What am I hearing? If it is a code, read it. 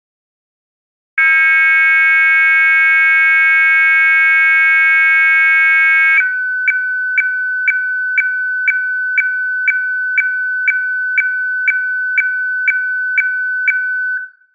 Weather fax (radiofax), 120 lines a minute, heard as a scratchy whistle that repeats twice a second, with room echo.